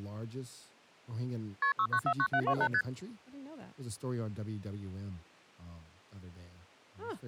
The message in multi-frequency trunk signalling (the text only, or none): KP 6949728 ST